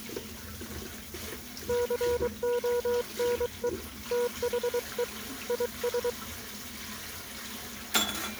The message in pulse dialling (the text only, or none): none